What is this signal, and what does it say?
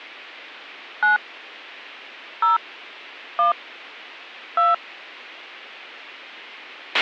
DTMF, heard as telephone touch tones, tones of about 140 ms, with a squelch burst at the end. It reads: 9 0 1 2